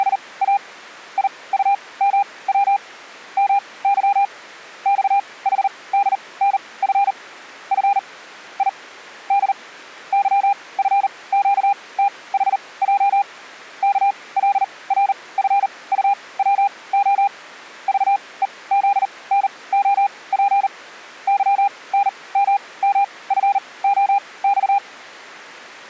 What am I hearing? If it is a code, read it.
Morse code, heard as a keyed tone, machine-sent, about 39 wpm, spaced as for 23 wpm, 800 Hz. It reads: … IUMW MY XHDNF F I D YFQTHJ KLRFUWO VEZNOP YNMMFOX